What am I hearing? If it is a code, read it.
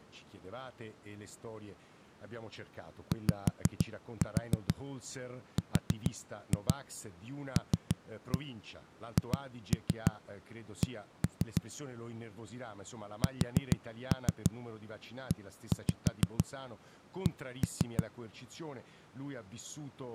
Tap code, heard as knocks on a wall, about 6 knocks a second, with speech in Italian. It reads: YRLHC SEC